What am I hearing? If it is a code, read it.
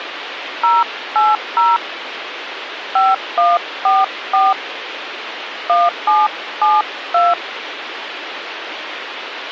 DTMF, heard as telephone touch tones, dialled by hand, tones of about 190 ms, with phone line noise. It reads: 080 5144 1772